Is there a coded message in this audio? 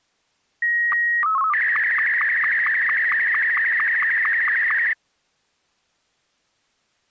Yes: SSTV (slow-scan television), Martin M2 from 0.6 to 4.9 s, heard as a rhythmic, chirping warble.